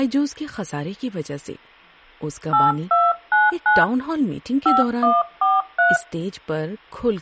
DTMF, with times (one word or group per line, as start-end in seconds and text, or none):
2.5-3.8 8299
4.7-6.0 5143